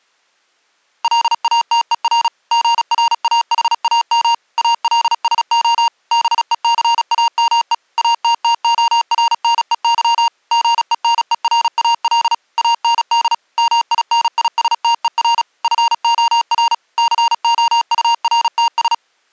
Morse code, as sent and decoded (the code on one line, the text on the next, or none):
.-.. .- - . .-. / --. .-. .- .... .- -- / .- .-.. ... --- / -... . -.-. .- -- . / .- - - --- .-. -. . -.-- / --. . -. . .-. .- .-.. / .- -. -.. / -- .. -. .. ... - . .-. / ..-. --- .-. / -.-. --- ..- .-. - ...
LATER GRAHAM ALSO BECAME ATTORNEY GENERAL AND MINISTER FOR COURTS